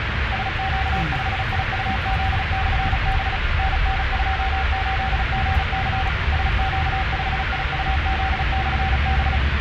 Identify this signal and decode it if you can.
Morse code, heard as a keyed tone, machine-sent, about 36 wpm, 770 Hz, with radio static and the noise inside a car. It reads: SQ5IUZ/B NN28GC SQ5IUZ/B